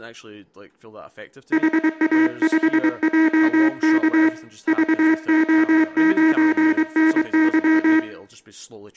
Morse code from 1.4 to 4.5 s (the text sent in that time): HA5JK